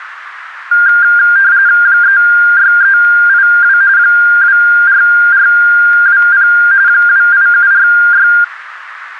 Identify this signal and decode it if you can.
RTTY (45.45 baud, 170 Hz shift), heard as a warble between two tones, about 1500 Hz centre, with radio static. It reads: 36382 24420 28746